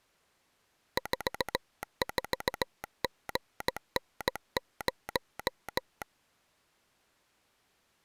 Morse code, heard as a telegraph sounder, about 17 wpm. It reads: 44GN0